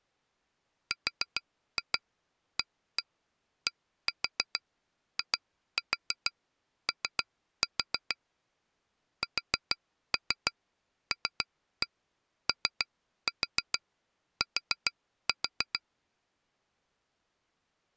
Tap code, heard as taps on glass, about 6 knocks a second. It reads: RADIO SLOT